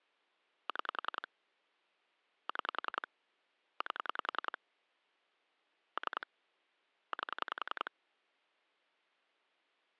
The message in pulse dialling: 6 6 8 3 8

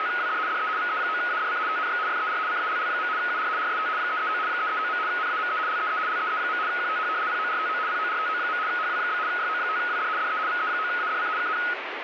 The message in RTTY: … DE VE9ADC TNX FER CALL. UR RST 339 339. NAME LEE LEE. QTH PORTO PORTO. HW? YO5WD DE VE9ADC KN

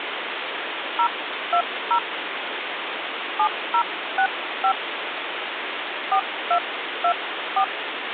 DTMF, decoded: 020 7065 4224

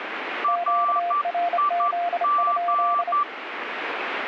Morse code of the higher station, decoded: RIG

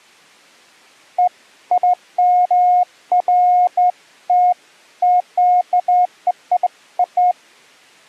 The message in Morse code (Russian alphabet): none

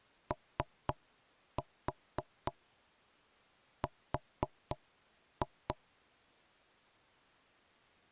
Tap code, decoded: OR

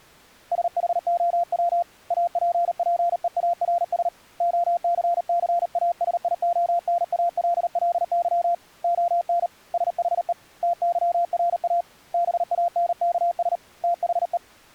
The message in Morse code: SHOW APPEARS OCCASIONALLY ON SHE TYRA BANKS THE

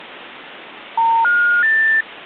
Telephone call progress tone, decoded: special information tone

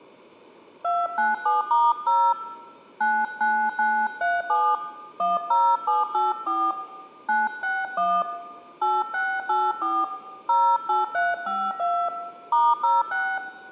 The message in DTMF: 297*0 99937 10784 961 8684 08352 *06

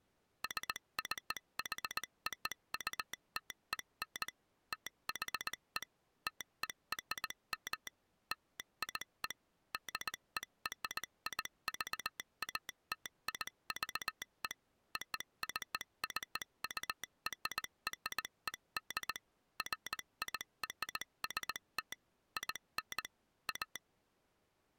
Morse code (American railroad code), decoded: SCHOUTEN THE TERM LIE DERIVATIVE OCCURRED FIRST IN A

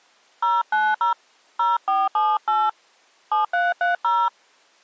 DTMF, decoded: 090 0478 7330

